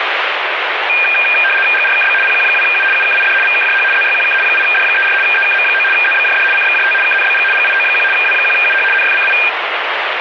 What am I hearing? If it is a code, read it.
RTTY (75 baud, 850 Hz shift), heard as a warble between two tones, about 2000 Hz centre, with radio static. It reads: GRKB PQ2U UKID VKJH ZYQK 8D34 EKM9 ZBJD CXJT KNBG GIO1 W1UH NFCI